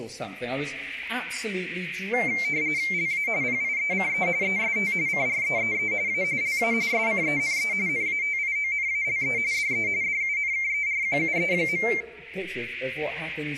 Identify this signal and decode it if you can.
RTTY (45.45 baud, 170 Hz shift), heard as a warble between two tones, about 2200 Hz centre. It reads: LA PIECE EST CREEE A LA SCENE NATIONALE DE DUNKERQUE.